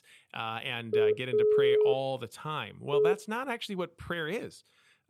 Telephone call progress tone (pulsed, as in Italy), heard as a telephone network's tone, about 420 Hz, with speech in English. Dial tone.